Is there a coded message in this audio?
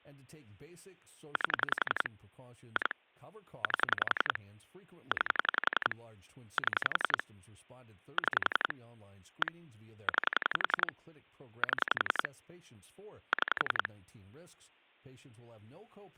Yes: pulse dialling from 1.4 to 13.9 s, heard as clicks on a phone line, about 11 pulses a second, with speech in English. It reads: 8 2 8 9 7 6 1 9 7 6